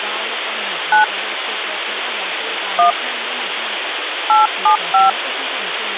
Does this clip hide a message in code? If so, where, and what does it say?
Yes: DTMF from 0.9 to 5.1 s, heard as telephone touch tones, dialled by hand, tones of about 130 ms, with phone line noise and speech in Goan Konkani. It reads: 9 1 875